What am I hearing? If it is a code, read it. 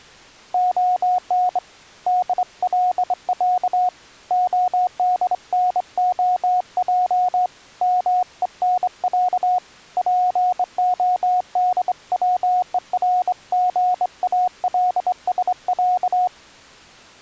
Morse code (Russian alphabet), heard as a keyed tone, hand-sent with a straight key, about 24 wpm, 730 Hz. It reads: ОН ДЛЯ ОДНОЙ МЕНЯ ПОДВЕРГАЛСЯ